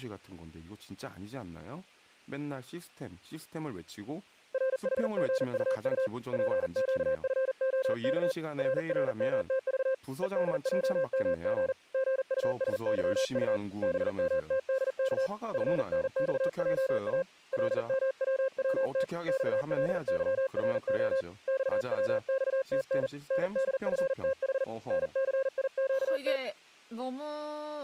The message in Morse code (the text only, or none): RHGUU PQFOK RRMTV EDJMG GUSYU BMTDK FNXJA LMWWT XLYRO XWXTN NDFTH NCIQT